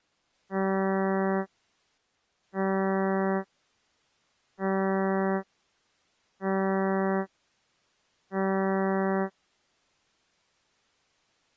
Ship horn signal, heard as a ship's horn, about 190 Hz. 5 short. At sea: I doubt that you are doing enough to avoid a collision.